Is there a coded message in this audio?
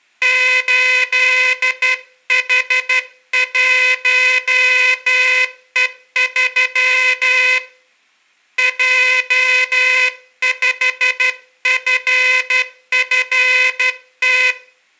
Yes: Morse code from 0.2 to 14.6 s, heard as a buzzer, hand-sent with a straight key, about 12 wpm, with room echo. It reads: 8H1E3 J5FFT